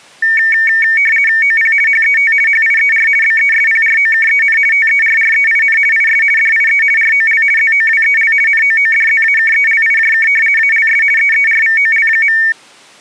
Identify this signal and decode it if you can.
RTTY (50 baud, 450 Hz shift), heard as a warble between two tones, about 2000 Hz centre. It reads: OP HET HIER BESPROKEN TERREIN IS DIE ROL ZOWEL NOODZAKELIJK ALS EERVOL.